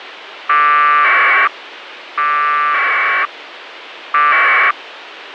Packet radio (AX.25, as in APRS), 1200 baud, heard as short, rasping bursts, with radio hiss.